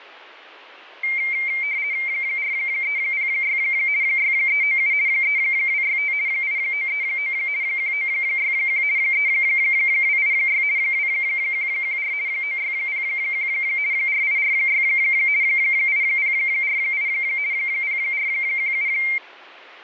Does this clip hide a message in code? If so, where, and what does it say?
Yes: RTTY (50 baud, 170 Hz shift) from 1.0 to 19.2 s, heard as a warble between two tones, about 2200 Hz centre. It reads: 4306 6397 3265 8939 1961 3286 2114 9601 4846 8048 0417